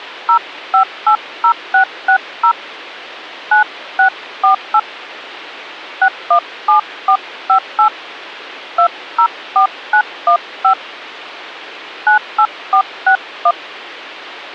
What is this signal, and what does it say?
DTMF, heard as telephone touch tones, dialled by hand, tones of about 90 ms. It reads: 0580660 9648 617458 204915 98461